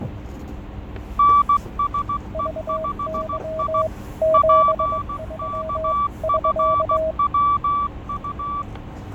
Morse code, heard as two keyed tones, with fading, static crashes and the noise inside a bus. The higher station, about 16 wpm, 1160 Hz: NSE5I PKFWU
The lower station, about 22 wpm, 640 Hz: VY 73 <SK>